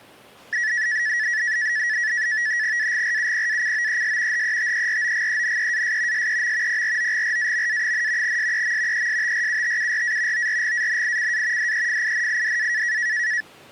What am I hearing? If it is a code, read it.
NAVTEX (SITOR-B), 100 baud, 170 Hz shift, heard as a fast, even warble, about 1800 Hz centre. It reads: AGRUPACOES HETEROGENEAS SEM PROGRAMA, SEM ESTRUTURA ORGANICA DEFINIDA